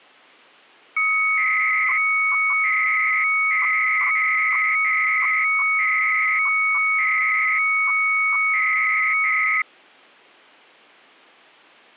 300-baud modem data (Bell 103 tones), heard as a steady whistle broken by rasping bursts, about 300 baud, 200 Hz shift.